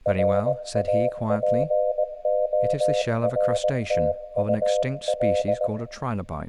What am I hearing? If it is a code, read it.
Morse code, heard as a keyed tone, hand-sent with a paddle, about 19 wpm, 610 Hz, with room echo and speech in English. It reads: RAPORTUL